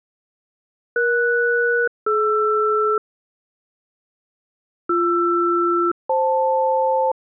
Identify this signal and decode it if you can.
Aircraft SELCAL, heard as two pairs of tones. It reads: ES-DR BR-FL